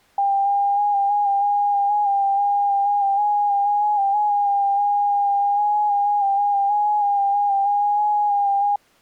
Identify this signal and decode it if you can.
FT8 (one signal), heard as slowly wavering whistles, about 6.25 baud.